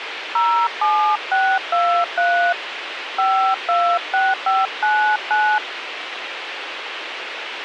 DTMF, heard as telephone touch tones, dialled by hand, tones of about 290 ms, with radio hiss. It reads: 07623 526599